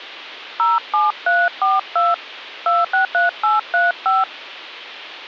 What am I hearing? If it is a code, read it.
DTMF, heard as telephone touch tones, dialled by hand, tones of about 170 ms, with hum. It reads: 07342 263835